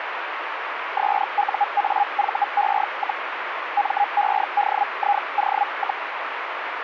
Hellschreiber (Feld-Hell, 122.5 baud), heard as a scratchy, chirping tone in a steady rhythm, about 820 Hz, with radio static. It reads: SUAVE, MEDIO,